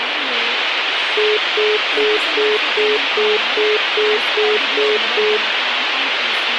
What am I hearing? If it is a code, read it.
Telephone call progress tone (single-tone plan, as in most of Europe), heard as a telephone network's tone, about 420 Hz, 0.2 s on and 0.2 s off, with phone line noise and speech in English. Congestion tone.